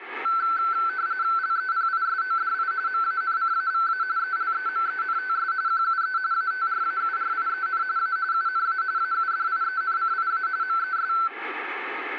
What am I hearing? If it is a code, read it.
RTTY (45.45 baud, 170 Hz shift), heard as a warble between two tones, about 1430 Hz centre, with radio static. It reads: LEPISODI MANCAVA ELEMENTS QUE ATRAURIEN A UNA AUDIENCIA MES